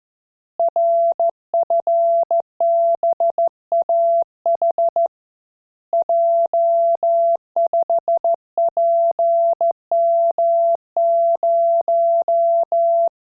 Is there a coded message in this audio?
Yes: Morse code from 0.5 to 13.1 s, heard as a keyed tone, hand-sent with a straight key, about 14 wpm, 680 Hz. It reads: RFBAH J5PM0